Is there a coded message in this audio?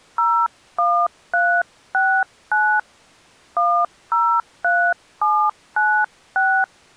Yes: DTMF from 0.2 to 6.6 s, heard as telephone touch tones, dialled by hand, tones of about 280 ms. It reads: 01369 103796